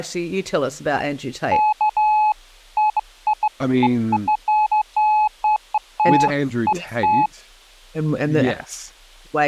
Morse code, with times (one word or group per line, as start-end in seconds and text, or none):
none